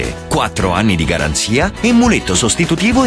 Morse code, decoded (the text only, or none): none